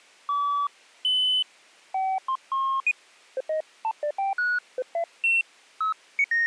Electronic bleeps of random pitch and length. There is no code.